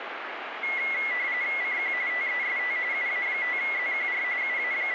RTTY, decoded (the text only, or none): CQ TEST UA5ZQR …